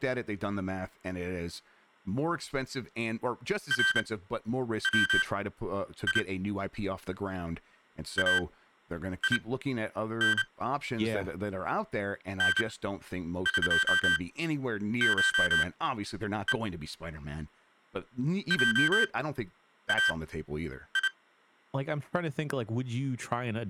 Morse code (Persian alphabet), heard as electronic beeps, machine-sent, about 29 wpm, spaced as for 9 wpm, 1550 Hz, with speech in English. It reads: روی این نقشه جای